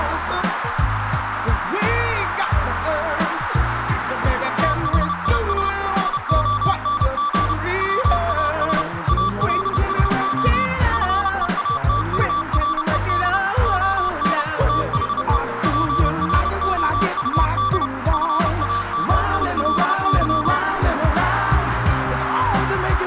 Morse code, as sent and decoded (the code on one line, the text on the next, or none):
- .... .. ... / ... --- -. --. / .-- .- ... / .- .-.. ... --- / ..-. . .- - ..- .-. . -.. / --- -. / - .... . / .--. .-. --- ..- -.. / ..-. .- -- .. .-.. -.--
THIS SONG WAS ALSO FEATURED ON THE PROUD FAMILY